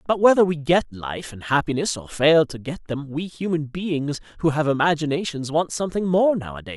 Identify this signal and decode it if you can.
Speech in English. There is no code.